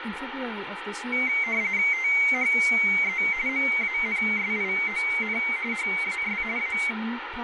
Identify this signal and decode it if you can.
RTTY (45.45 baud, 170 Hz shift), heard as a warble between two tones, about 2150 Hz centre, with radio static and speech in English. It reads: THE MANSION HAS A